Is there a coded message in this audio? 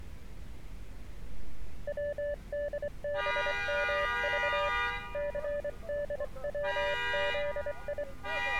Yes: Morse code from 1.8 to 8.1 s, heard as a keyed tone, hand-sent with a straight key, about 24 wpm, 580 Hz, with street noise. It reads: WDBMV CDWZI